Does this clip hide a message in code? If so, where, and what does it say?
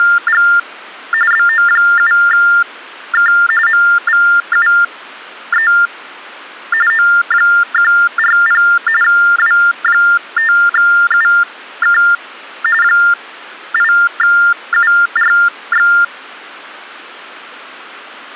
Yes: TTY/TDD text telephone tones (45.45 baud Baudot) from 0.0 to 16.0 s, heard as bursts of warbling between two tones, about 400 Hz shift, 1600 Hz centre. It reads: … BO7K MVUE O140 W5UK 8URX